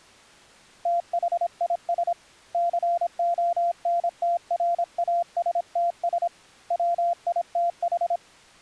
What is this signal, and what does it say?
Morse code, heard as a keyed tone, hand-sent with a paddle, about 26 wpm, 690 Hz. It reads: THIS CONTRASTS WITH